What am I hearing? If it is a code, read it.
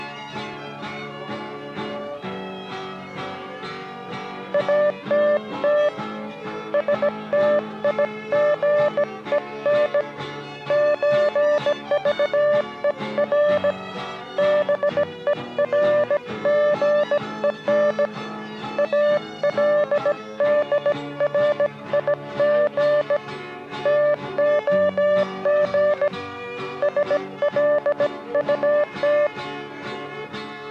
Morse code (with Swedish letters), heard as a keyed tone, hand-sent with a bug key, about 17 wpm, 590 Hz. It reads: ATT STIGEN ÖVER BERGEN ALDRIG TOG SLUT